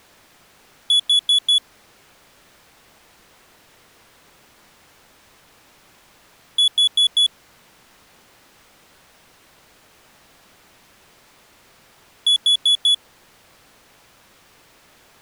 Alarm pattern, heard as an alarm's beeps, played three times, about 3400 Hz. Temporal four. Carbon monoxide.